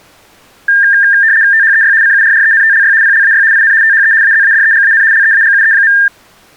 RTTY (75 baud, 170 Hz shift), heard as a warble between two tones, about 1700 Hz centre. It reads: THEY CURRENTLY PLAY IN THE AZADEGAN LEAGUE.